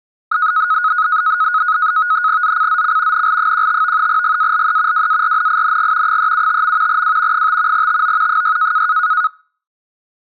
NAVTEX (SITOR-B), 100 baud, 170 Hz shift, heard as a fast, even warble, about 1360 Hz centre. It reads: ZCZC NL15 GALE WARNING 375. W 5 TO 6